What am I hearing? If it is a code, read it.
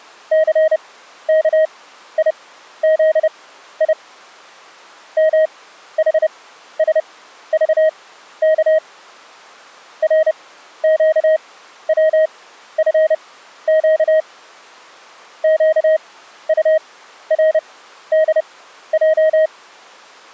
Morse code, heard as a keyed tone, machine-sent, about 30 wpm, spaced as for 13 wpm, 630 Hz. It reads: CKIZI MHSVK RQWFQ QURDJ